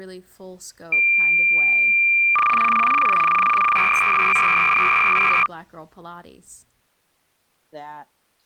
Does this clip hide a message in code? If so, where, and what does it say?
Yes: cassette data (Kansas City type), 300 baud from 0.9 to 5.5 s, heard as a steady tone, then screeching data, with speech in English.